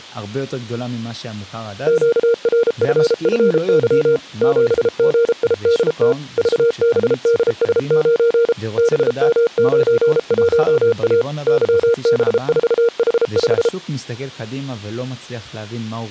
Morse code, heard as a keyed tone, machine-sent, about 33 wpm, 470 Hz, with speech in Hebrew. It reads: QRFFY 7GIDT VBDS9 BM91A YB4H5